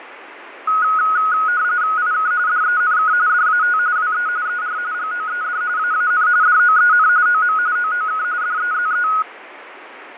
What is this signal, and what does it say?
RTTY (45.45 baud, 170 Hz shift), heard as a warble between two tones, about 1360 Hz centre, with radio static and fading. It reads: IK DENK DAT WE ER GOED AAN DOEN OM OOK DEZE